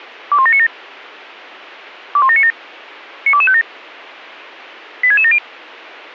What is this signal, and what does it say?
Five-tone selective call (ZVEI), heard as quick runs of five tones, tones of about 70 ms. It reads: 21797 21797 92257 86670